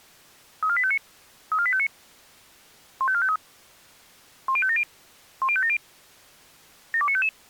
Five-tone selective call (ZVEI), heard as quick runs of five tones, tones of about 70 ms. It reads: 34859 34859 15453 10570 10570 72955